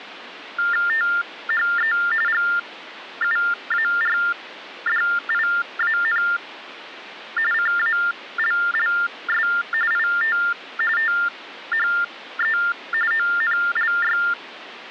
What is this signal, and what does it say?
TTY/TDD text telephone tones (45.45 baud Baudot), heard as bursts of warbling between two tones, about 400 Hz shift, 1600 Hz centre, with phone line noise. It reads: THE GUARDIAN CALLS IT THE ONLY